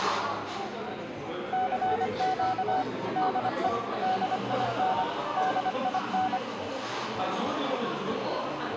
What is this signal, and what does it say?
Morse code, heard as a keyed tone, machine-sent, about 25 wpm, 750 Hz, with a squelch burst at the end and the noise of a cafe. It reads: CQ DE DIN DIN